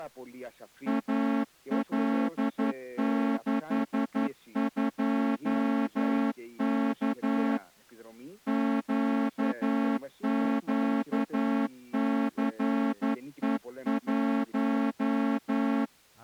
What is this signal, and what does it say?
Morse code, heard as a horn, hand-sent with a straight key, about 11 wpm. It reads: AL62K QQCE1